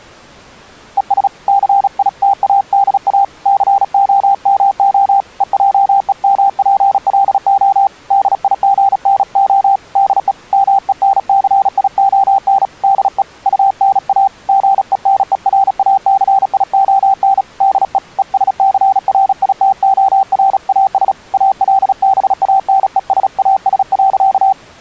Morse code, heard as a keyed tone, hand-sent with a paddle, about 36 wpm, 780 Hz. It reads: ES CITADA COMO EJEMPLO DIGNO DE MENCION DE UNA GENERACION DE ESCRITORAS ALBANESAS.